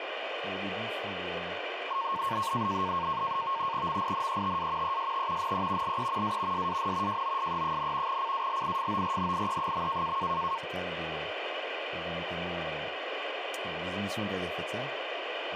NAVTEX (SITOR-B), 100 baud, 170 Hz shift, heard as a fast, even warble, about 1000 Hz centre, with radio static and speech in French. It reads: MINETA EST NE LE A SAN JOSE, CALIFORNIE.